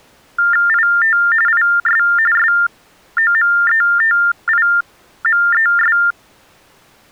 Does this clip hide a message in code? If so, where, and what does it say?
Yes: TTY/TDD text telephone tones (45.45 baud Baudot) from 0.4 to 6.1 s, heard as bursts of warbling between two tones, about 400 Hz shift, 1600 Hz centre. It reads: IT IS SOMETIMES